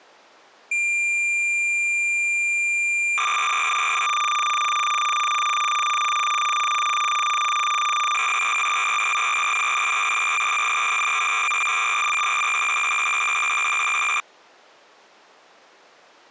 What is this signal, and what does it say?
Cassette data (Kansas City type), 300 baud, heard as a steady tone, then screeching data.